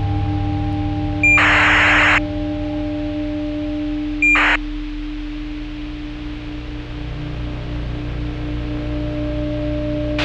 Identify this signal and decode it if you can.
ACARS aircraft data, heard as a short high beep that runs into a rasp, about 2400 baud, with a squelch burst at the end.